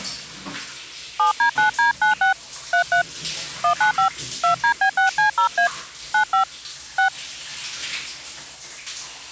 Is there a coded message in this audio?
Yes: DTMF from 1.2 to 7.1 s, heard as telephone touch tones, dialled by hand, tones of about 110 ms, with the noise of a restroom. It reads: 7D9D96 33 195 2DB6C0A 95 6